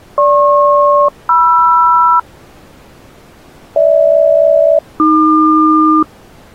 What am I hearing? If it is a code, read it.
Aircraft SELCAL, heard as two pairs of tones. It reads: GP-MR GH-AQ